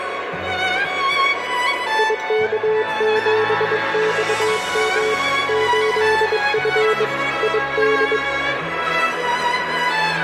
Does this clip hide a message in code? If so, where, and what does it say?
Yes: Morse code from 1.9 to 8.2 s, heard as a keyed tone, hand-sent with a bug key, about 22 wpm, 430 Hz, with radio static. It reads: IK7XM 8F ID